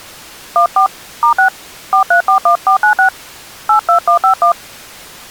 DTMF, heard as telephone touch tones, dialled by hand, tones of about 100 ms. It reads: 14 *6 4341496 82151